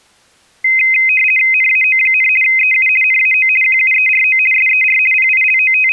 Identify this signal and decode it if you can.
RTTY (50 baud, 450 Hz shift), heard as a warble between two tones, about 2300 Hz centre. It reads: NAO, EU NAO QUERO SER …